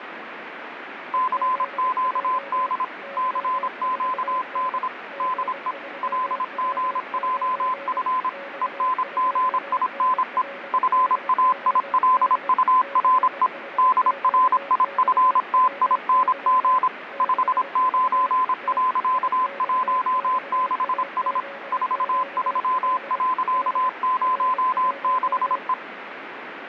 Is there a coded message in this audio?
Yes: Morse code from 1.1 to 25.8 s, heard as a keyed tone, machine-sent, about 26 wpm, 1020 Hz, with radio static and a weaker station near 560 Hz. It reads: CQD CQD DE LGJF ENGINE FAILURE DRIFTING 59.16S 43.06E